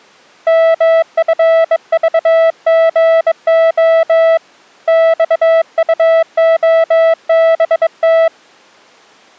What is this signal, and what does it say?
Morse code, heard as a keyed tone, hand-sent with a bug key, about 22 wpm, 660 Hz. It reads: MFVGO XUOBT